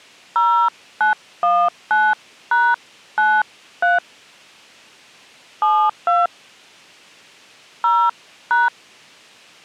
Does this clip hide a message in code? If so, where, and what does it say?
Yes: DTMF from 0.4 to 8.7 s, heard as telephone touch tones, dialled by hand, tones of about 230 ms. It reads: 0919#93 72 0#